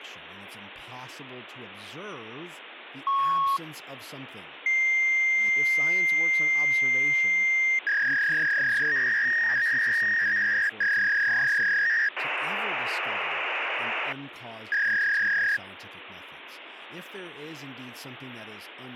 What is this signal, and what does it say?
Fax machine handshake, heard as a beep, a long tone, a warble and hiss, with phone line noise and speech in English.